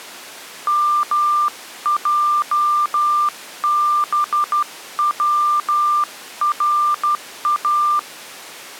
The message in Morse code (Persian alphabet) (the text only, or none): مجبورا